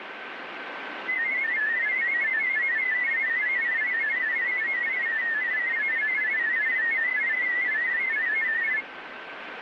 Multi-tone FSK (Olivia or MFSK type), about 500 Hz wide, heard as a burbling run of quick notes, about 31.25 baud, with radio static and a steady whistle near 1540 Hz.